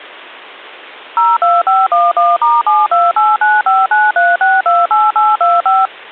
DTMF, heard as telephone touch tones, dialled by machine, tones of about 200 ms. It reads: 02511*7289593628825